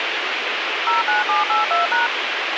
DTMF, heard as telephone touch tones, dialled by machine, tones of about 150 ms, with radio hiss and a squelch burst at the end. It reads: 09782#